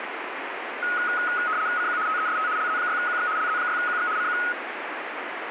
RTTY (75 baud, 170 Hz shift), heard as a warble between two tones, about 1360 Hz centre, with radio static. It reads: CQ TEST LZ6QX LZ6QX CQ